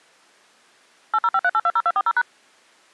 DTMF, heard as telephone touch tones, dialled by machine, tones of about 50 ms. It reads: 8053820240#